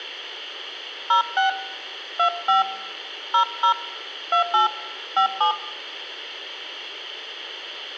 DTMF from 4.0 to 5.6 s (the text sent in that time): 28 57